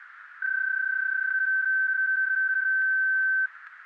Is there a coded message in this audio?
Yes: PSK31 (31.25 baud) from 0.4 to 3.5 s, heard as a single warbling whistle, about 1550 Hz, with radio static.